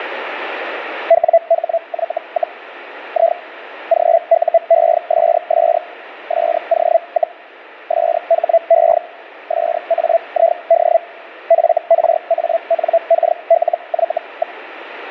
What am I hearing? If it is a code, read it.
Hellschreiber (Feld-Hell, 122.5 baud), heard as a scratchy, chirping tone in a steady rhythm, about 670 Hz, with radio static. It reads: WHY, I GUESS SO, SHE SAID FRANKLY.